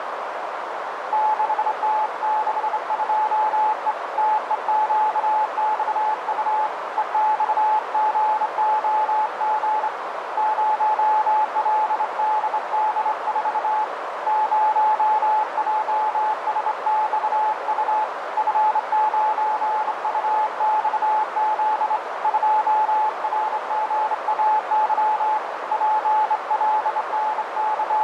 Morse code, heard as a keyed tone, hand-sent with a straight key, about 26 wpm, 860 Hz, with radio static and a narrow filter. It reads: 6T62E TEQXU EXGOG 0LDD4 0JSXU F9UXZ 2RGAY …